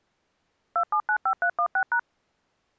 DTMF, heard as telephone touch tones, dialled by machine, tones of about 80 ms. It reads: 2795316#